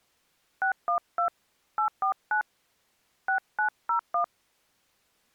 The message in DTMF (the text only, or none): 612 849 6901